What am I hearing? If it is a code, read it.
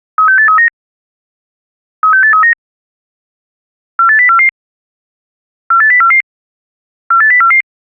Five-tone selective call (CCIR), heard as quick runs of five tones, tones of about 100 ms. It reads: 36839 36839 48044 48044 48044